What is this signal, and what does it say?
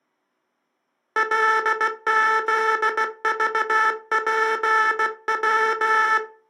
Morse code, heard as a buzzer, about 16 wpm. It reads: LZVPW